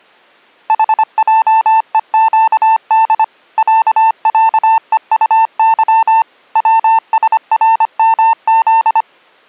Morse code (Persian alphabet), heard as a keyed tone, machine-sent, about 25 wpm, 900 Hz. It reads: حجهگد صصهطظ وسرمز